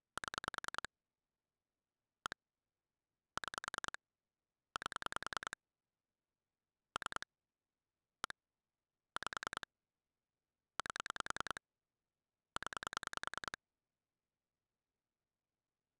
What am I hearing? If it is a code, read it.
Pulse dialling, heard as clicks on a phone line, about 10 pulses a second. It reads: 7 1 6 8 3 1 5 8 0